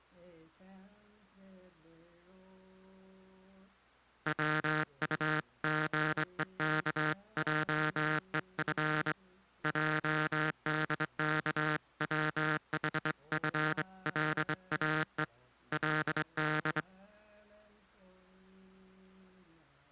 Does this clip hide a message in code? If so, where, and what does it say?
Yes: Morse code (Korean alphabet) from 4.2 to 16.9 s, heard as a buzzer, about 23 wpm. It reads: 비상한 흥분과 그